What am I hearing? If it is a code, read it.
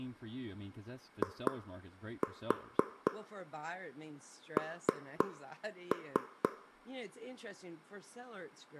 Tap code, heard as taps on a table, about 4 knocks a second, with room echo and speech in English. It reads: IN